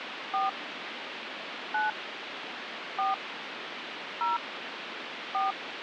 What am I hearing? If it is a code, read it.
DTMF, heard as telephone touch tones, dialled by hand, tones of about 160 ms, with phone line noise. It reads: 4 9 4 0 4